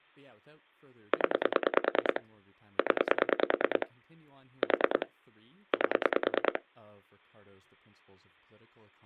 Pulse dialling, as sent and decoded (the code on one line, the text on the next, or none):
10 / 10 / 4 / 8
0 0 4 8